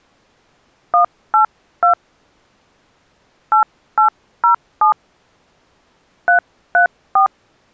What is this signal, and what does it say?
DTMF, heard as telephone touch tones, dialled by hand, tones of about 110 ms. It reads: 182 8807 334